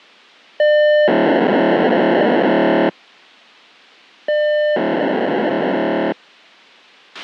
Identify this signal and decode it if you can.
POCSAG pager data (1200 baud), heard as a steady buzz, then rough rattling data, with a squelch burst at the end.